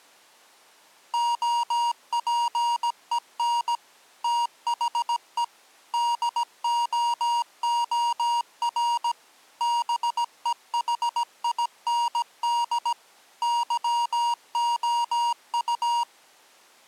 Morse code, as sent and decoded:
--- .--. . -. / - .... . / -.. --- --- .-. / -... . .... .. -. -.. / -.-- --- ..-
OPEN THE DOOR BEHIND YOU

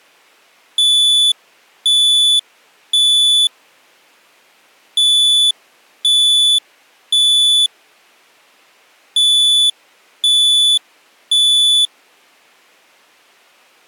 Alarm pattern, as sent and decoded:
3 beeps and a pause
temporal three

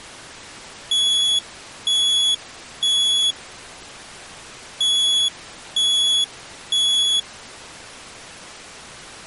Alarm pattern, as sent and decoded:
3 beeps and a pause
temporal three

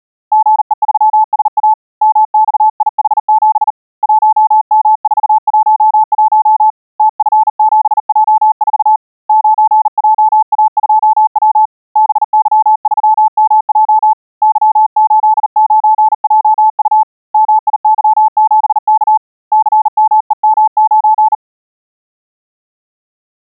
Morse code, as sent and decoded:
--. . ...-- ... .- / -- -..- .. .... --... / .---- -- ....- .---- .---- / - ..-. --... .--- ....- / ----. .--- .- ..--- .-- / -... -.-- ...-- -- .--- / -.-- ---.. ----. .--- ..- / -- .. -.-- --... -.- / -.-. -- . -- ----.
GE3SA MXIH7 1M411 TF7J4 9JA2W BY3MJ Y89JU MIY7K CMEM9

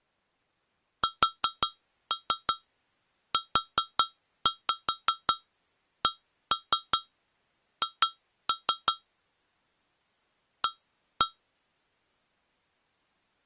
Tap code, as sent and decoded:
4-3 4-5 1-3 2-3 / 1-1
SUCH A

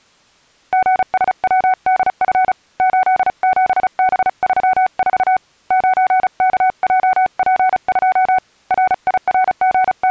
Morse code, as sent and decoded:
--. ... .-- -.. ..-. / ---.. --... -... ...-- ....- / ----. -.- .--- .--. ..--- / …
GSWDF 87B34 9KJP2 …

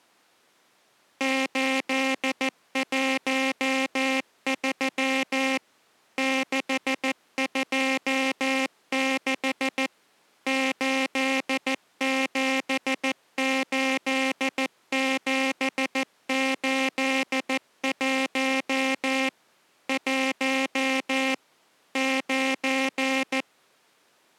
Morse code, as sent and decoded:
---.. .---- ...-- / -.... ..--- -.... / ---.. --... ---.. --... ---.. .---- / .---- / ----.
813 626 878781 1 9

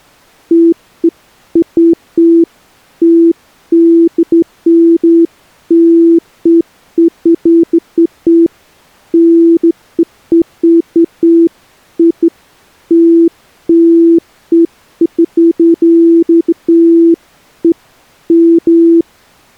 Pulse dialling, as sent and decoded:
none

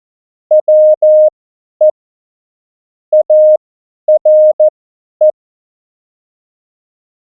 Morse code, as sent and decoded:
.-- . / .- .-. .
WE ARE

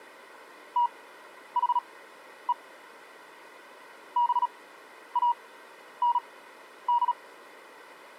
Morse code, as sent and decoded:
- .... . / -... .- -. -..
THE BAND

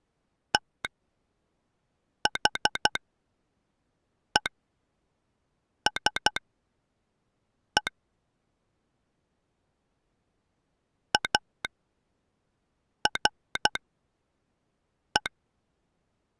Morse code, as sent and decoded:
- .... . ... . / .- .-. .
THESE ARE

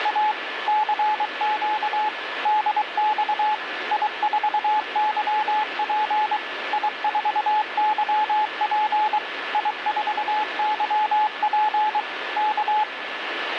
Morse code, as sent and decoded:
… / -.-. --.- / -.. -..- / .. ....- -.-- .--. / .. ....- -.-- .--. / .. ....- -.-- .--. / -.-
… CQ DX I4YP I4YP I4YP K

